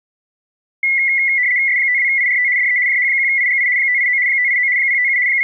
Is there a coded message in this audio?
Yes: RTTY (75 baud, 170 Hz shift) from 0.8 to 5.4 s, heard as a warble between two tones, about 2050 Hz centre. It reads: S52IRT DE JH1IGI 589 589 057 …